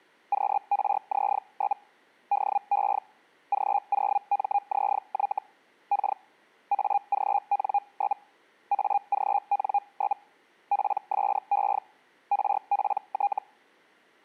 Hellschreiber (Feld-Hell, 122.5 baud), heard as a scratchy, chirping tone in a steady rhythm, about 810 Hz. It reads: QRZ? DE G0MZY K AGN? AGN? PSE RPT